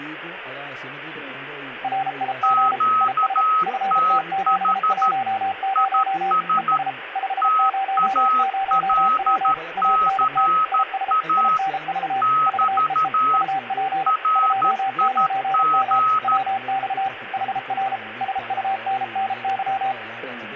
Morse code, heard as two keyed tones, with radio static. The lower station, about 33 wpm, 780 Hz: RIG IS FT710 ES 500W ANT IS INV VEE UP 29M WX HR SUNNY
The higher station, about 13 wpm, 1280 Hz: QTH IS TALCA <BT> RIG